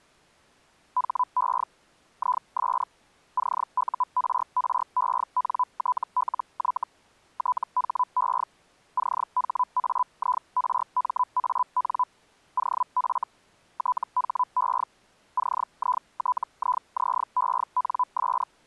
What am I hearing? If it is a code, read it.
Hellschreiber (Feld-Hell, 122.5 baud), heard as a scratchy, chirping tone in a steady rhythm, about 1000 Hz. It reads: HE IS CURRENTLY THE CHAIRMAN OF THE CITIZENS